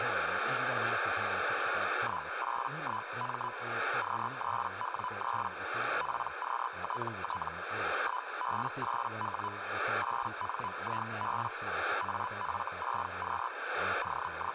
Hellschreiber (Feld-Hell, 122.5 baud), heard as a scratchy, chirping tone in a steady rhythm, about 1000 Hz, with radio static, a narrow filter and speech in English. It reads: 181M Q3W3 PQTT 1B8W 8NIB AF6Q …